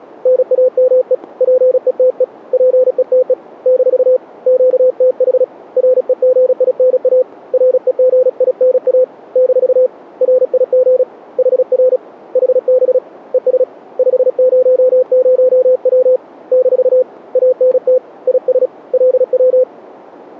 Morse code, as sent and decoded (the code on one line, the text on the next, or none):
-. .- -- . / .--. . - . / .--. . - . / -....- / --.- - .... / .-. . --. .. -. .- / .-. . --. .. -. .- / -....- / .-. .. --. / .... .-. / .... -... / . ... / ..... ----- ----- .-- / -....- / .- -. - / .. ... / .-.. .--
NAME PETE PETE - QTH REGINA REGINA - RIG HR HB ES 500W - ANT IS LW